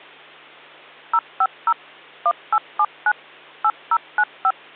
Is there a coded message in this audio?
Yes: DTMF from 1.1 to 4.5 s, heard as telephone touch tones, dialled by machine, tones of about 60 ms, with hum. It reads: 050 1879 8095